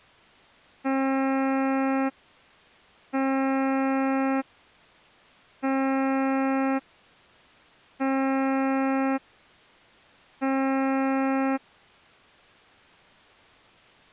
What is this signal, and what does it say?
Ship horn signal, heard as a ship's horn, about 270 Hz. 5 short. At sea: I doubt that you are doing enough to avoid a collision.